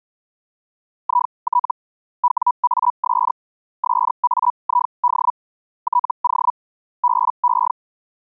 Hellschreiber (Feld-Hell, 122.5 baud), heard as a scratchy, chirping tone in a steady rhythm, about 980 Hz. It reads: IT WAS SAID TO BE